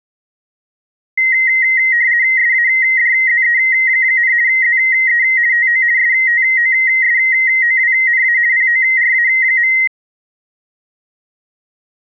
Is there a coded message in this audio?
Yes: RTTY (50 baud, 170 Hz shift) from 1.2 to 9.9 s, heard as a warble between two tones, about 2000 Hz centre. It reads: SADZE, ZE TO STOSOWNA PORA.